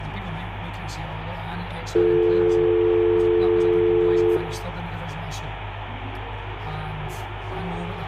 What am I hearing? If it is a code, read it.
Telephone call progress tone (North American or UK plan), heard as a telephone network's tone, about 350, 440 Hz, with hum and room echo. Dial tone.